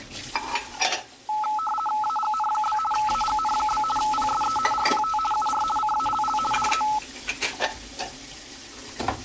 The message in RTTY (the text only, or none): AGN? AGN? PSE RPT UR CALL DE